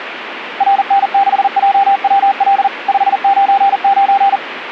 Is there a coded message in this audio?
Yes: Morse code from 0.5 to 4.4 s, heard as a keyed tone, machine-sent, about 40 wpm, 790 Hz, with radio static. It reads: RN6JWL 599